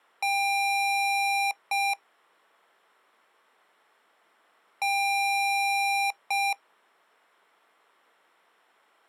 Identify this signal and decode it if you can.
Beep code, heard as beeps from a small speaker, played twice, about 800 Hz. 1 long, 1 short. In IBM BIOS tables: system board problem.